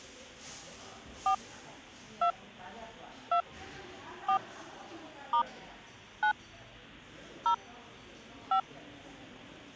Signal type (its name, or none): DTMF